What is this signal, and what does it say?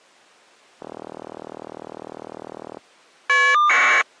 Caller ID data burst, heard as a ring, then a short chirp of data, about 1200 baud.